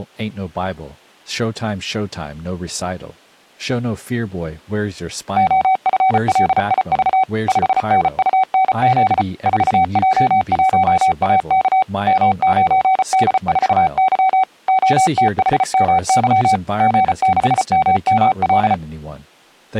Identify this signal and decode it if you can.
Morse code, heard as a keyed tone, machine-sent, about 34 wpm, 760 Hz, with speech in English. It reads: OFLIV 5NUNZ 4J1AK M9D4Y OTHMY G6MML